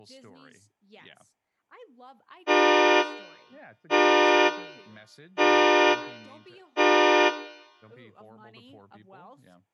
Train horn signal, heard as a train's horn, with speech in English. 4 short. On North American railways: a request for a signal to be given or repeated.